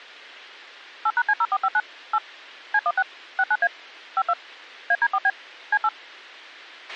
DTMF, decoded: 8#C0459 8 C16 69A 52 AD4B C8

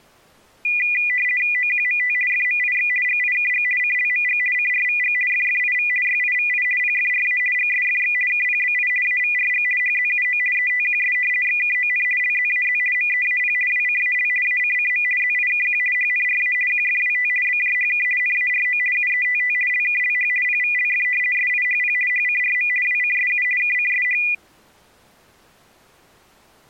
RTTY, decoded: OQMT FMIX GIKG CLMG CRVG FFIV YIVI PFRA GSFX KPBI AVRG HZUO ETQS XKON LZAZ MEAP WCAL ACCM ZIKQ HNRA QFWT BJHK NARO UETT LKLH PVLF SIHP HCRM WCSU KCSH

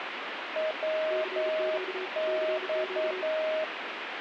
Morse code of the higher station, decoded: WX

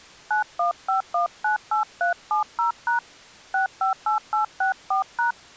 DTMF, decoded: 915198370# 658864#

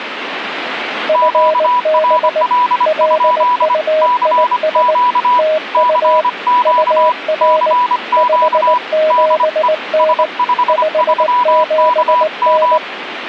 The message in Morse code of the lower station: FB LUIS TU UR 57N 57N

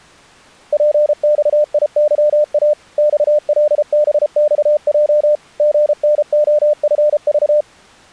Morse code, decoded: PXIYA XLBXJ GNOFV

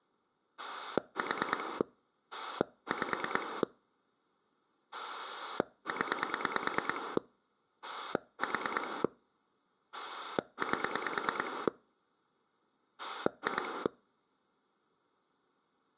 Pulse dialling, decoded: 4 5 0 4 8 2

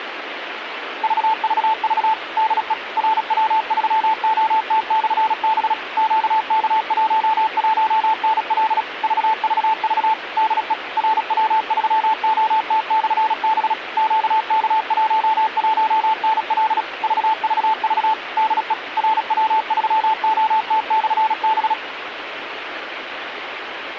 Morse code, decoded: VVV DE RW3OT/B QK11NL VVV DE RW3OT/B QK11NL VVV DE RW3OT/B

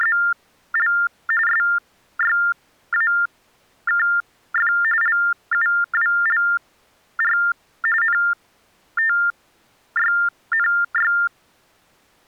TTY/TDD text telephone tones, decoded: … SYAKF LUWLR NTYNY

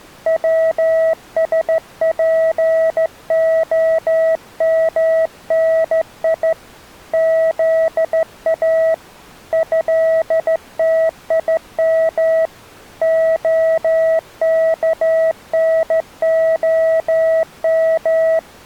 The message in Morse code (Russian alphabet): ВСПОМНИ ЗА ЭТИМ ОКНОМ

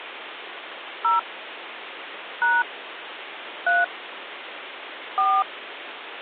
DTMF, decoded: 0 # 3 4

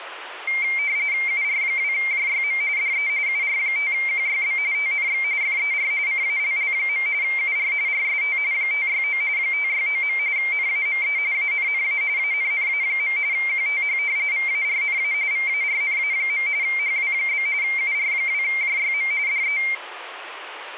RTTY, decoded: UR2JYM DE UR5QYB TNX FER CALL. UR RST 569 569. NAME ANNA ANNA. QTH VARNA VARNA. HW? UR2JYM DE

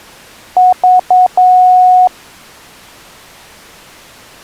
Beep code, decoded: 3 short, 1 long

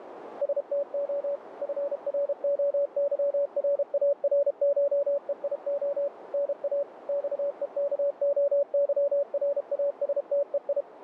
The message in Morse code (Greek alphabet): ΣΤΟ ΦΡΟΥΡΑΡΧΕΙΟ ΝΑ ΞΕΚΟΥΡΑΣΤΕΙ

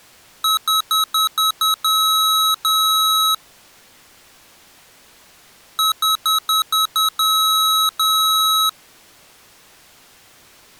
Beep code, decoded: 6 short, 2 long

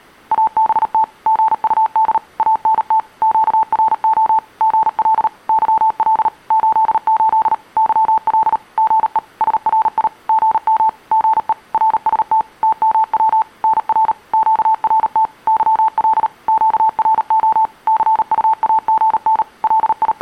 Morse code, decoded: ABT GUD ANT QRO GL YL 88 YL GE SRI GM GE RST TMW NR QRT YL QRO CUAGN …

